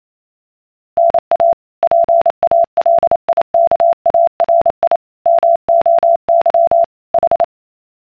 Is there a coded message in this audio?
Yes: Morse code (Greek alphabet) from 0.9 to 7.5 s, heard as a keyed tone, machine-sent, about 28 wpm, 680 Hz. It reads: ΝΑ ΠΑΛΙΚΑΡΙ ΜΟΥ Η